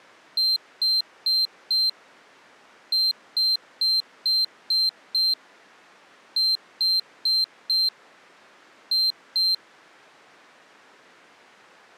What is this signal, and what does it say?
Beep code, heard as a piezo beeper, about 4150 Hz. 4-6-4-2.